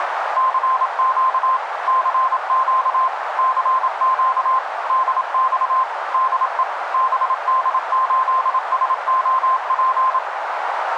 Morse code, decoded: CQ CQ CQ DX DE BD8SOP

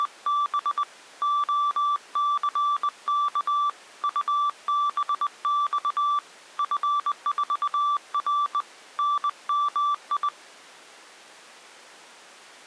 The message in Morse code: … OCK UBX F4R NMI

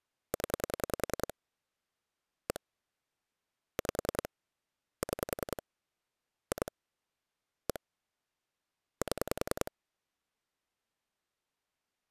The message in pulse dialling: 0 1 5 6 2 1 7

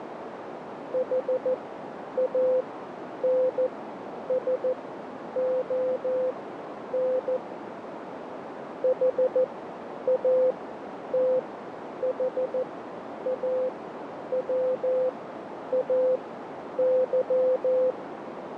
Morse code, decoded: HANSON HATHAWAY

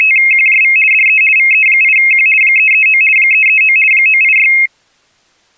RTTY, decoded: … DE VE8Q 339 339 986

